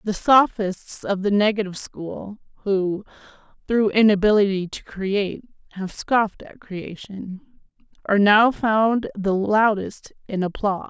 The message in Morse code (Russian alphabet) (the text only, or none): none